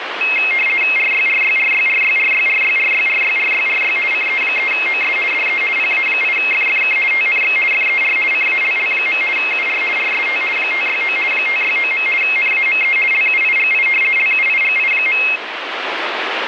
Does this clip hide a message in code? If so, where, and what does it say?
Yes: RTTY (50 baud, 450 Hz shift) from 0.2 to 15.4 s, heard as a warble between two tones, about 2350 Hz centre, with radio static. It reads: RYRYRYRYRYRYRYRYRYRY CE3OS DE PA8FFK TNX FER CALL. UR RST 569 569. NAME LUIGI LUIGI.